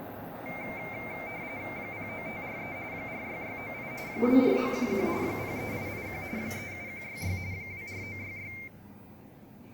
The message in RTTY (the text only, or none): 09543 46698 24911 03881 37166 24966